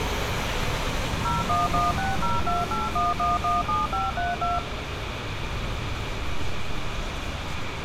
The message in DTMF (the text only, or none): 01160281117532